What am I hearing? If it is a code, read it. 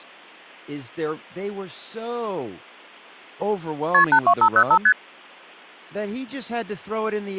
Multi-frequency trunk signalling (R1, as on North American trunks), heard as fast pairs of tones, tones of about 70 ms, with speech in English. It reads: KP 82505 ST